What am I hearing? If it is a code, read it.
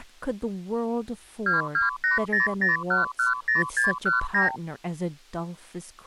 Multi-frequency trunk signalling (R2, with the far end's replies), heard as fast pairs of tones, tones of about 140 ms, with speech in English. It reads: 22800110619